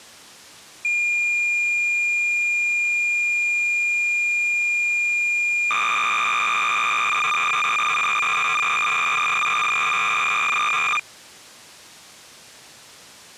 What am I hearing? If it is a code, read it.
Cassette data (Kansas City type), 300 baud, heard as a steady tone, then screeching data.